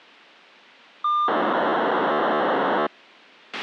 POCSAG pager data (2400 baud), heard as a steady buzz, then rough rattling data, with a squelch burst at the end.